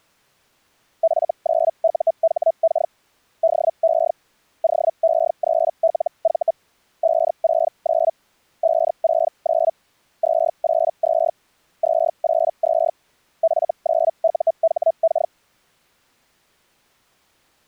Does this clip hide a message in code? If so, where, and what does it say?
Yes: Hellschreiber (Feld-Hell, 122.5 baud) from 1.0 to 15.3 s, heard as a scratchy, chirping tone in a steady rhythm, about 660 Hz. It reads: F9UHK DE OE3LV 569 569 282 282 F9UHK